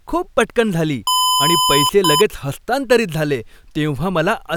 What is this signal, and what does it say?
Beep code, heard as beeps from a small speaker, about 1010 Hz, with speech in Marathi. 1 long, 1 short. In IBM BIOS tables: system board problem.